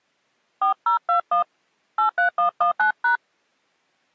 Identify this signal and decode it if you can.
DTMF, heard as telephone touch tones, dialled by hand, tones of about 110 ms. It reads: 4021 83119#